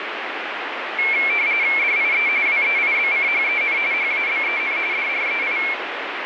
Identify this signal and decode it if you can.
RTTY (45.45 baud, 170 Hz shift), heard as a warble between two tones, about 2250 Hz centre, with radio static. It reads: DIE WEIBCHEN HABEN DREI